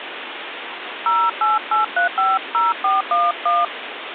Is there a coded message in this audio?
Yes: DTMF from 1.1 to 3.6 s, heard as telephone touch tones, dialled by hand, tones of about 180 ms, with phone line noise. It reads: 088350411